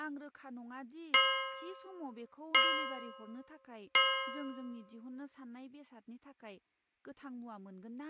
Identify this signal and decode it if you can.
Clock strike, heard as a bell, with room echo and speech in Bodo. 3. Three o'clock.